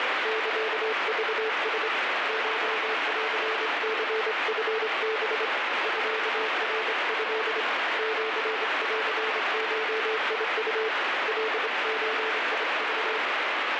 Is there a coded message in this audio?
Yes: Morse code (Japanese Wabun code) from 0.2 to 13.2 s, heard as a keyed tone, hand-sent with a straight key, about 26 wpm, 440 Hz, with heavy radio static. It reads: サクラ コンニチハ ミナト シンゴウ カゾク